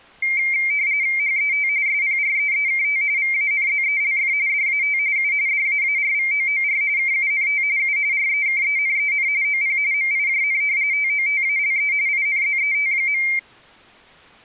RTTY (45.45 baud, 170 Hz shift), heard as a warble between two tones, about 2200 Hz centre. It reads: HET SPREEKT VANZELF DAT U DAARVOOR KUNT U REKENEN OP MIJN TOTALE INZET.